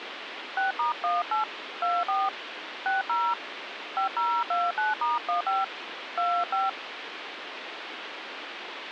DTMF, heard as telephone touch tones, dialled by hand, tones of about 180 ms, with phone line noise. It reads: 6*18 24 60 5029*15 25